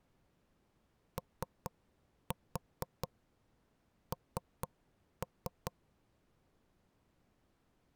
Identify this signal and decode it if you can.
Tap code, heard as knocks on wood, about 4 knocks a second. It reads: ON